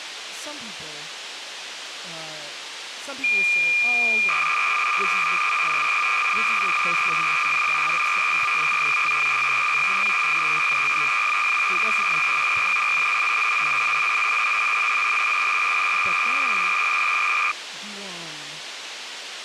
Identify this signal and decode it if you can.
Cassette data (Kansas City type), 300 baud, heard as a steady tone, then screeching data, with tape hiss and speech in English.